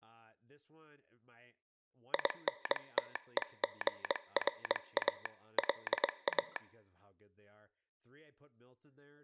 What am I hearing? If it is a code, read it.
Morse code, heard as a telegraph sounder, hand-sent with a paddle, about 22 wpm, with speech in English. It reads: INTEGRA LA